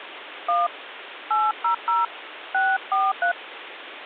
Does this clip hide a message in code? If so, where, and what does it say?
Yes: DTMF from 0.5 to 3.3 s, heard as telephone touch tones, dialled by hand, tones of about 160 ms, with phone line noise. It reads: 1 800 643